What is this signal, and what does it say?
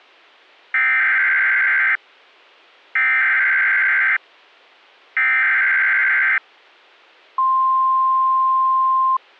Emergency Alert System (SAME) tones (header bursts, then the 1050 Hz attention tone), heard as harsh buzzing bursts, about 520.83 baud.